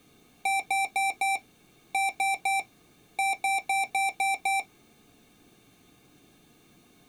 Beep code, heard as beeps from a small speaker, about 780 Hz. 4-3-6.